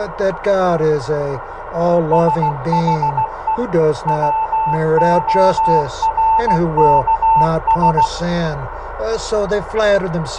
Morse code, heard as a keyed tone, machine-sent, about 16 wpm, 890 Hz, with radio static and a narrow filter. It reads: SHE WORKS